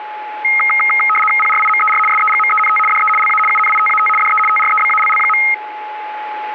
RTTY (75 baud, 850 Hz shift), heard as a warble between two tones, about 1700 Hz centre, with a steady whistle near 850 Hz. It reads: PRIMER SEGMENT DE LA UNITAT DE TREBALL.